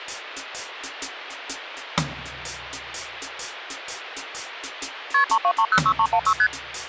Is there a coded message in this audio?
Yes: multi-frequency trunk signalling (R1, as on North American trunks) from 5.1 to 6.5 s, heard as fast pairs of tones, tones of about 70 ms. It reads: KP 32306316 ST